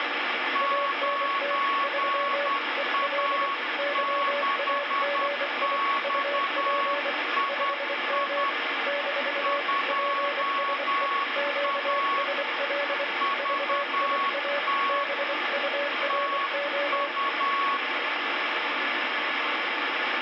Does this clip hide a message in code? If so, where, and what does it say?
Yes: Morse code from 0.5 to 17.8 s, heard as two keyed tones, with heavy radio static. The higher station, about 10 wpm, 1110 Hz: 9A6XII 2A VT TU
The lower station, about 24 wpm, 570 Hz: ANT 3 EL YAGI UP 5M - PSE QSL VIA BURO